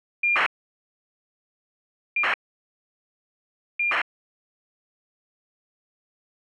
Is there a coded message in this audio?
Yes: ACARS aircraft data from 0.2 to 4.0 s, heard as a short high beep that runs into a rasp, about 2400 baud.